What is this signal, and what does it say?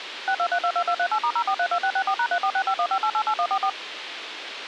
DTMF, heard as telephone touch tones, dialled by machine, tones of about 70 ms, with radio hiss. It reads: 62322238*0432664#346515888144